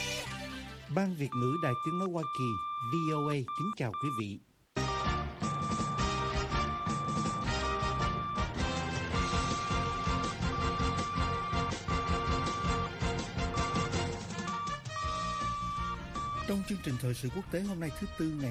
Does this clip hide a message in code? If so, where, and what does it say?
Yes: Morse code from 1.3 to 16.5 s, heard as a keyed tone, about 5 wpm, 1170 Hz. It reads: ZJOER